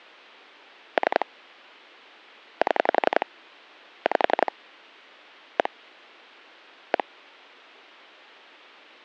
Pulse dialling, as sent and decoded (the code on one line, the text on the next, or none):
3 / 7 / 5 / 1 / 1
3 7 5 1 1